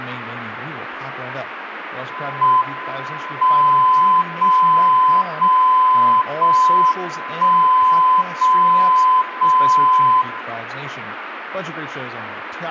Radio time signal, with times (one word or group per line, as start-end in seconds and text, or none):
2.4-3.4 M
3.4-4.4 0
4.4-5.4 0
5.4-6.4 0
6.4-7.4 1
7.4-8.4 0
8.4-9.4 0
9.4-10.4 0